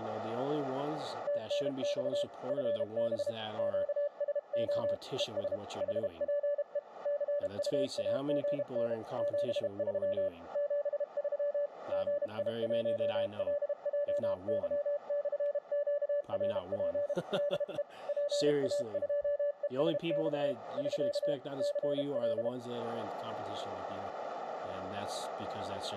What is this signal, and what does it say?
Morse code, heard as a keyed tone, hand-sent with a paddle, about 32 wpm, 580 Hz, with radio static and speech in English. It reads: TNX FB QSO ES HPE CUAGN 73 73 GI1LJY/QRP DE PA2ESX <SK> CL